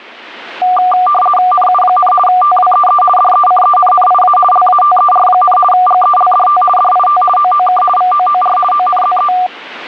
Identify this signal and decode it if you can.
RTTY (50 baud, 450 Hz shift), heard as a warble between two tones, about 960 Hz centre. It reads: NU, TWEE DECENNIA LATER, GELDT DIT OOK VOOR ONZE